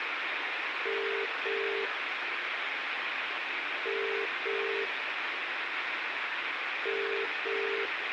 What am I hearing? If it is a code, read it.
Telephone call progress tone (as in the UK, Ireland, Australia and similar networks), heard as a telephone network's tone, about 400, 450 Hz, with phone line noise and room echo. Ringback tone.